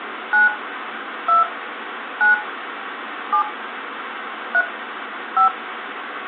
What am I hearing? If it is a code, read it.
DTMF, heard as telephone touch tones, dialled by hand, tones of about 100 ms, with phone line noise. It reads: 9 2 9 7 3 5